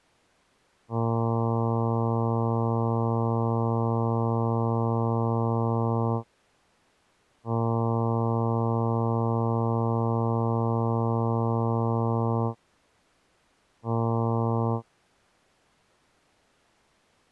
Ship horn signal, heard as a ship's horn, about 120 Hz. 2 long, 1 short. At sea: I intend to overtake on your starboard side.